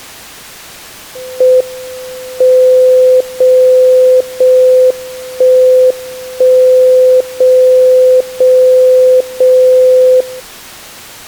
Radio time signal (JJY), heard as a tone whose level steps once a second, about 510 Hz. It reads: M 0 0 1 1 0 0 0 0